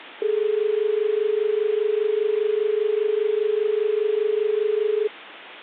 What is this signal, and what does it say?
Telephone call progress tone (as in Australia), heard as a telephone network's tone, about 430 Hz. Dial tone.